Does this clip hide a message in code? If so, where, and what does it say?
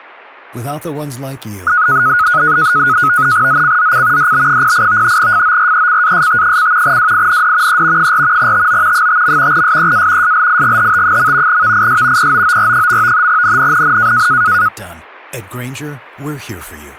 Yes: NAVTEX (SITOR-B), 100 baud, 170 Hz shift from 1.7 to 14.7 s, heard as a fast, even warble, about 1360 Hz centre, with speech in English. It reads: ZCZC DB08 FORECAST: WIND E 4 TO 5. SEA SLIGHT. VIS POOR. NNNN